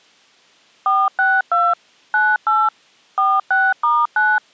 DTMF, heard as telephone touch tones, dialled by machine, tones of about 220 ms. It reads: 462 98 46*9